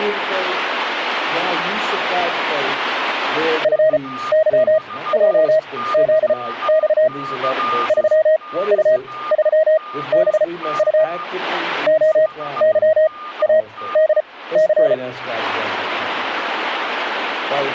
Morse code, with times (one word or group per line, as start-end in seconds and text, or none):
3.6-7.1 FYJZX
7.9-11.0 3U3BU
11.9-14.9 OYADC